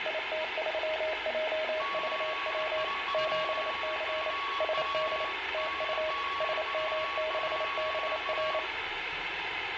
Morse code, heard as two keyed tones, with radio static, room echo and the noise inside a bus. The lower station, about 28 wpm, 630 Hz: IT3JVW 7C SD TU SM6BR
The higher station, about 23 wpm, 1120 Hz: 8I2FW DGV2A